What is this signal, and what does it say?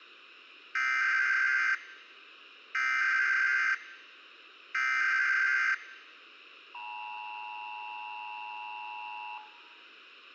Emergency Alert System (SAME) tones (header bursts, then the 853 and 960 Hz attention tone), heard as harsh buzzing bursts, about 520.83 baud.